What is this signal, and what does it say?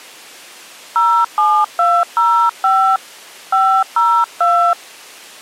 DTMF, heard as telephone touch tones, dialled by hand, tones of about 280 ms. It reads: 07205 502